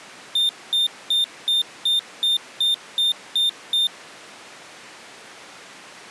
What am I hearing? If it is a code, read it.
Beep code, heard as a piezo beeper, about 3600 Hz. 10 short. In AMI BIOS tables: CMOS shutdown register error.